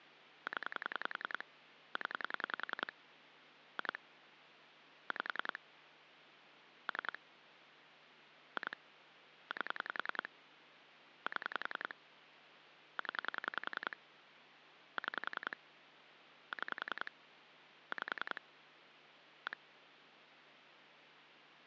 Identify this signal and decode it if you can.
Pulse dialling, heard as clicks on a phone line, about 10 pulses a second, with phone line noise. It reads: 0 0 2 5 3 2 8 7 0 6 6 5 1